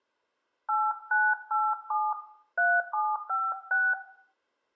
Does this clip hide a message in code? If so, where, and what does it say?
Yes: DTMF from 0.7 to 3.9 s, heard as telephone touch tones, dialled by hand, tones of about 230 ms, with room echo. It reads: 8987 3756